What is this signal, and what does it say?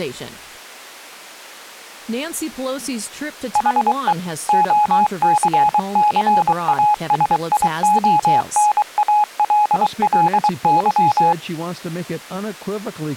Morse code, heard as a keyed tone, machine-sent, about 23 wpm, 840 Hz, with speech in English. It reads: HE OCCASIONALLY